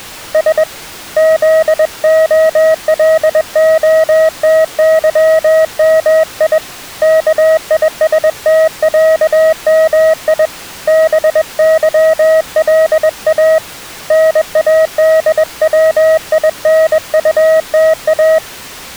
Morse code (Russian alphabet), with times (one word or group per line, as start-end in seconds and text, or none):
0.3-0.6 С
1.2-6.6 ЗОЛОТЫМИ
7.0-10.5 КИСТЯМИ
10.9-13.6 БЫЛА
14.1-18.4 НАДВИНУТА